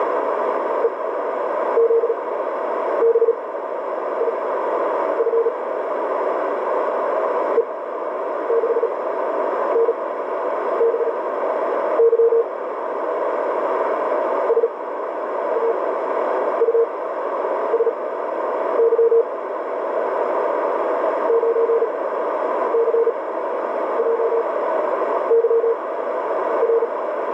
Morse code, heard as a keyed tone, machine-sent, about 37 wpm, spaced as for 9 wpm, 460 Hz, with heavy radio static and a narrow filter. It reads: EZBIF E6NBY SAUSY 9CJYR